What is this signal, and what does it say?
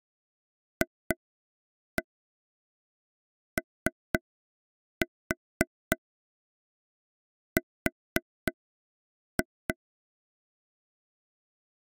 Tap code, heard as taps on a table, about 3 knocks a second. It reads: FOR